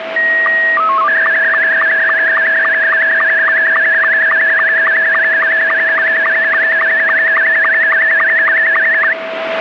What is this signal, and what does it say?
SSTV (slow-scan television), Scottie S2, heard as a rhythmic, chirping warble, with radio static and a steady whistle near 650 Hz.